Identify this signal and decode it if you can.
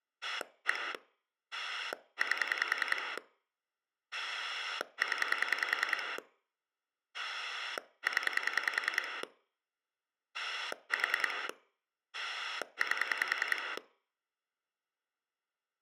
Pulse dialling, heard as a rotary dial, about 10 pulses a second. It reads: 1 8 0 0 4 8